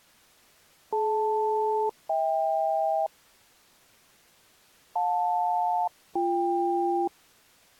Aircraft SELCAL, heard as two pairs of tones. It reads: DL-HK JL-BK